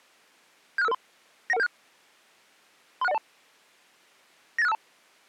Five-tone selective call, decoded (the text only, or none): 76553 91176 36102 98652